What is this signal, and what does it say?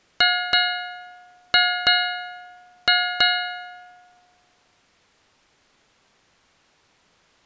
Ship's bell, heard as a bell. 6. Six half-hours of the watch have passed.